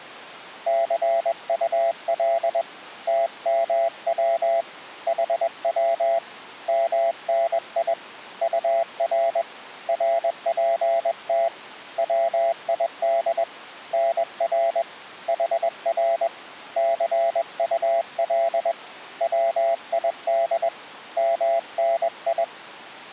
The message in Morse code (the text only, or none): CUL TMW HW MNI UR RPT WID NR HR CUL WID MNI